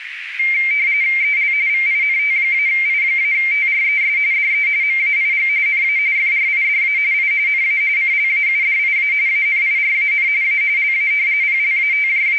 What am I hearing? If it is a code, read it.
RTTY (45.45 baud, 170 Hz shift), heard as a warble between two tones, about 2200 Hz centre, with radio static and a narrow filter. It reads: EL VINT-I-TRES DE MAIG NA FRIDA I NA CLAUDIA ANIRAN A LA …